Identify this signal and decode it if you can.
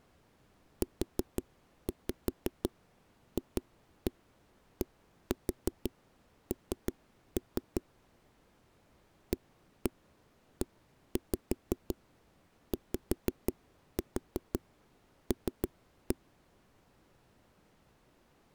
Tap code, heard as knocks on a wall, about 5 knocks a second. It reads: UFDN AEYL